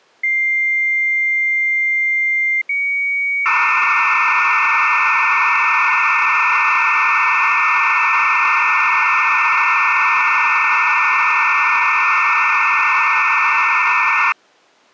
Dial-up modem handshake (low-speed, two carriers), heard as two whistles, then hiss.